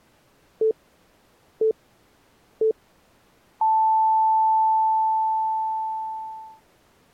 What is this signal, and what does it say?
Radio time signal (three low pips and a long one an octave up, as on NHK), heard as pips.